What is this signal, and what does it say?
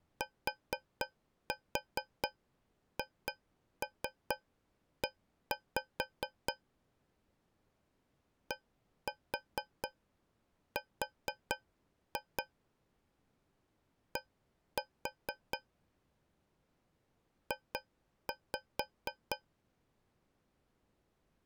Tap code, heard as taps on a metal pipe, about 4 knocks a second. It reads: THE DR D J